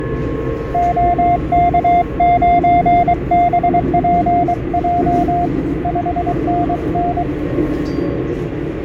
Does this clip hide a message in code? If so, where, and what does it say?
Yes: Morse code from 0.7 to 7.3 s, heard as a keyed tone, hand-sent with a paddle, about 23 wpm, 700 Hz, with fading and the noise inside a subway train. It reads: OK9BPJ 5NN